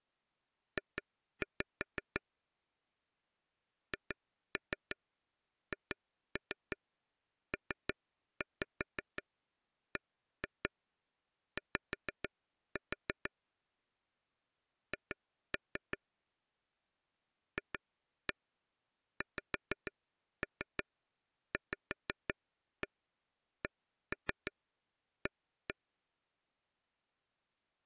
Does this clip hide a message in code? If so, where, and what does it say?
Yes: tap code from 0.8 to 25.7 s, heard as taps on a table, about 6 knocks a second. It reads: J HHPBY H FXVCA